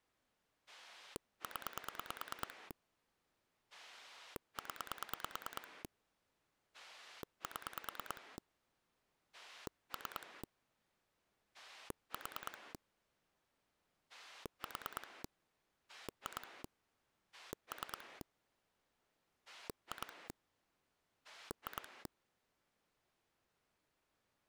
Pulse dialling, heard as a rotary dial, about 9 pulses a second. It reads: 0 0 7 3 4 4 2 3 2 2